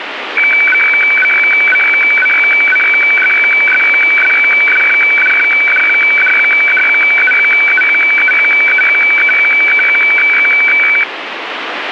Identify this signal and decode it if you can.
Weather fax (radiofax), 120 lines a minute, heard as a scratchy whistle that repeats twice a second, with radio static.